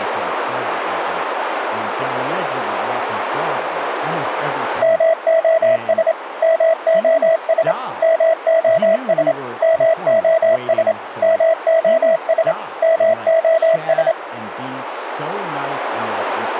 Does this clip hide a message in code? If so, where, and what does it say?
Yes: Morse code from 4.8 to 14.2 s, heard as a keyed tone, machine-sent, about 27 wpm, 650 Hz, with radio static and speech in English. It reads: MOS MOS MOS MOS MOS MOS